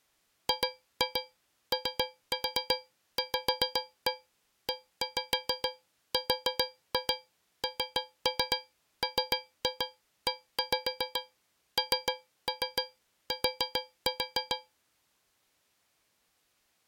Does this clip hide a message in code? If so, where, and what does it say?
Yes: tap code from 0.5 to 14.7 s, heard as taps on a metal pipe, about 7 knocks a second. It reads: GOVERNMENT